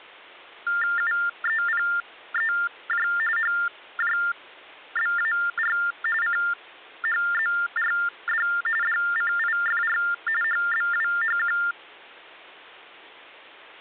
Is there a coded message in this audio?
Yes: TTY/TDD text telephone tones (45.45 baud Baudot) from 0.7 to 11.7 s, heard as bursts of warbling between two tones, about 400 Hz shift, 1600 Hz centre. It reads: UEPEJ HJBAR CHZRD DCIFR HBWHQ